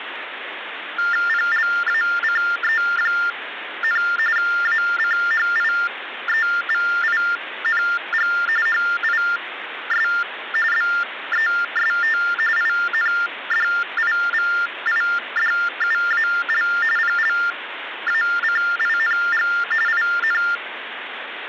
TTY/TDD text telephone tones (45.45 baud Baudot), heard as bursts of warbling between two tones, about 400 Hz shift, 1600 Hz centre, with phone line noise. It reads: PLACE, ACHIEVING HIS BEST INDIVIDUAL PLACING IN